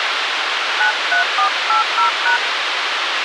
DTMF, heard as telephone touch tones, dialled by hand, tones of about 120 ms, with radio hiss and a squelch burst at the end. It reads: 93480#